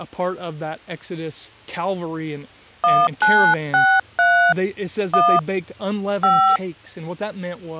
DTMF, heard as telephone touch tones, dialled by hand, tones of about 280 ms, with speech in English. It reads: 1963 1 5